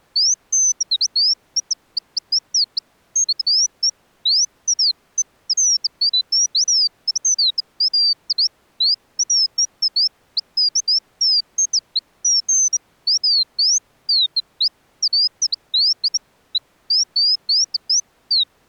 Bird-like chirps. There is no code.